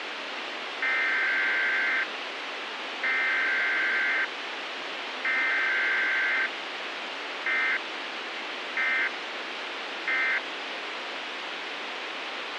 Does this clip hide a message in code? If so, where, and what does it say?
Yes: Emergency Alert System (SAME) tones (header bursts, then end-of-message bursts) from 0.8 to 10.4 s, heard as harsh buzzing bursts, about 520.83 baud, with radio hiss.